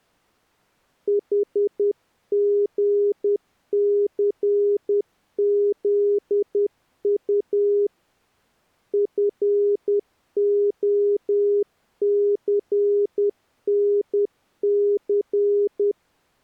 Morse code, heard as a keyed tone, hand-sent with a paddle, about 10 wpm, 410 Hz. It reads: HGCZU FOCNC